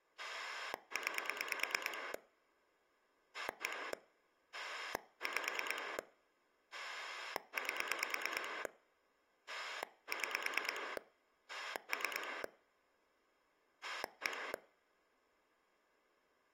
Pulse dialling, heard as a rotary dial, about 9 pulses a second. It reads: 9 1 5 8 6 3 1